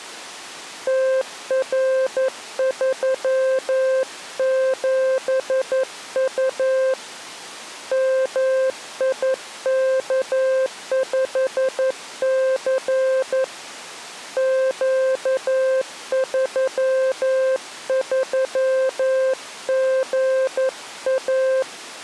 Morse code, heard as a keyed tone, hand-sent with a paddle, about 11 wpm, 520 Hz. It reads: TR37U MIK5C Q33GA